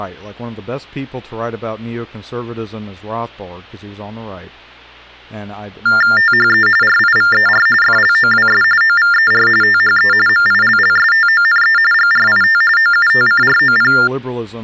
TTY/TDD text telephone tones (45.45 baud Baudot), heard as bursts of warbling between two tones, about 400 Hz shift, 1600 Hz centre, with speech in English. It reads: THE RIVER FLOWS OVER THE MILLSTONE GRIT OUTCROP